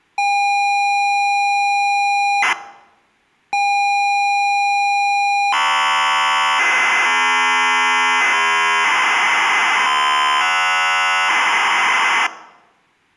ZX Spectrum tape loading, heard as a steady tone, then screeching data.